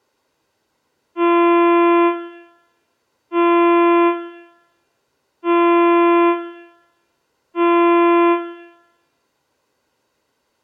Ship horn signal, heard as a ship's horn, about 340 Hz, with room echo. 4 short. At sea: a pilot vessel's identity signal in fog.